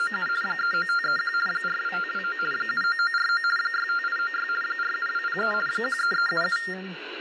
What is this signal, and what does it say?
RTTY (50 baud, 450 Hz shift), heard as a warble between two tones, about 1600 Hz centre, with radio static and speech in English. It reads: … 39531 42529 79949 65896 47203 13377